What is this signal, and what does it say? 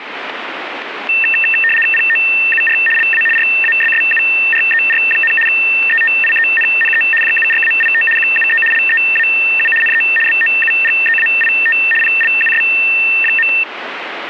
RTTY (75 baud, 850 Hz shift), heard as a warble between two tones, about 2250 Hz centre, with radio static. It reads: POUR LA RASSURER, ETIENNE JURAIT QUE LEAU NE BOUGEAIT PLUS.